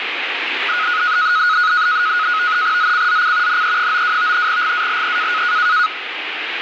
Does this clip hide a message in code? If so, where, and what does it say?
Yes: NAVTEX (SITOR-B), 100 baud, 170 Hz shift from 0.7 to 5.9 s, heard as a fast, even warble, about 1360 Hz centre, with radio static. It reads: ZCZC NE92 GALE